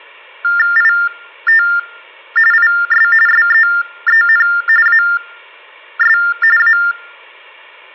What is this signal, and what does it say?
TTY/TDD text telephone tones (45.45 baud Baudot), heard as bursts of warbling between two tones, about 400 Hz shift, 1600 Hz centre. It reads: IT IS SEEN AS A